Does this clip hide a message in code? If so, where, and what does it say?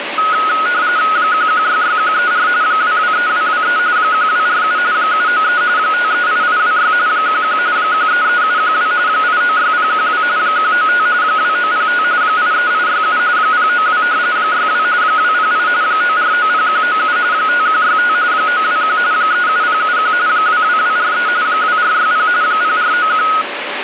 Yes: RTTY (45.45 baud, 170 Hz shift) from 0.2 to 23.4 s, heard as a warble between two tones, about 1360 Hz centre, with radio static. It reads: 1166134 223223 1247 793 538826 11 133712 896012 195 2905 83867 092 62 208 9490197 5165 921 37071 22243 2460 0491